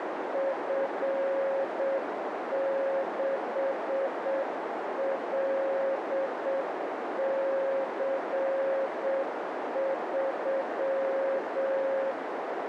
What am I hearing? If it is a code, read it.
Morse code, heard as a keyed tone, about 7 wpm, 540 Hz, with heavy radio static and a narrow filter. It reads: F6LC3